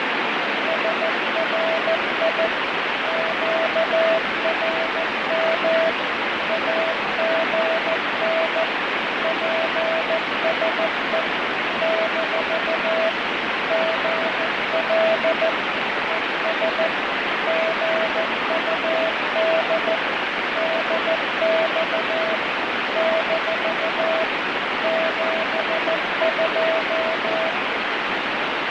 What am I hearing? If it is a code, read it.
Morse code, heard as a keyed tone, machine-sent, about 14 wpm, 650 Hz, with heavy radio static. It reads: SRI QRM AGN PSE - GL ES GUD DX - 72